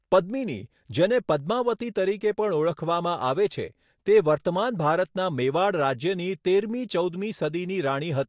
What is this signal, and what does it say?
Speech in Gujarati. There is no code.